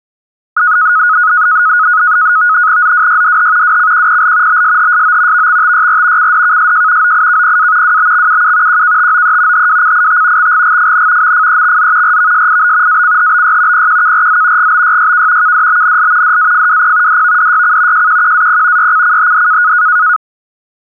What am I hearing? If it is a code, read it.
NAVTEX (SITOR-B), 100 baud, 170 Hz shift, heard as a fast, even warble, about 1360 Hz centre. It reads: ZWYDH WCQPL BSHSO VXTYR CDKSJ OIKPA WBXUU QKTOE HWCIT XGGFN MFEXZ RVSIB ACHBY PQKRZ GBYYK KDBNL DAFWP DVDYC JQQAP YCCHD